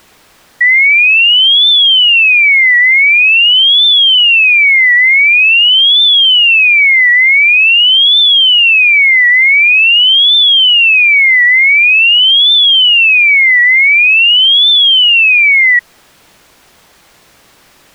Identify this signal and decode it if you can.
A tone that sweeps in pitch again and again. There is no code.